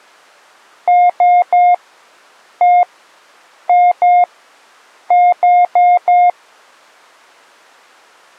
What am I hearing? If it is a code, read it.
Beep code, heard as beeps, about 710 Hz. 3-1-2-4.